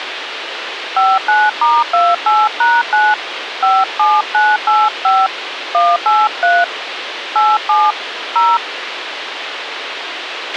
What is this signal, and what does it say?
DTMF, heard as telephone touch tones, dialled by hand, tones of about 220 ms, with radio hiss and a squelch burst at the end. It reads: 59*28#9 57985 183 87 0